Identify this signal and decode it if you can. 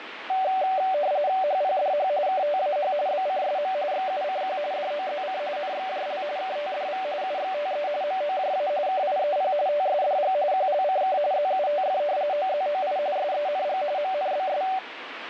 RTTY (45.45 baud, 170 Hz shift), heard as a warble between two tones, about 670 Hz centre, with radio static. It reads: HPDH KTAH BCSM XUCQ DOZC NXJL KTDV UXTE MOJA KIEP TSDG QLCK ZUTF OZOI SENG MNBS